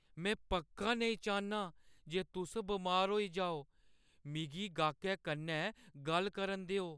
Speech in Dogri. There is no code.